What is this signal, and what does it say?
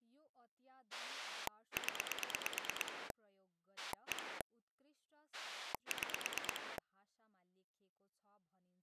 Pulse dialling, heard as a rotary dial, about 9 pulses a second, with speech in Nepali. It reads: 0 1 6